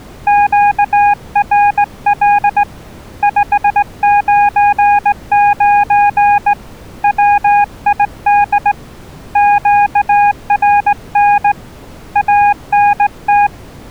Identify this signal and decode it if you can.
Morse code, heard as a keyed tone, hand-sent with a straight key, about 18 wpm, 820 Hz. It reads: QRL 599 WID QRN ANT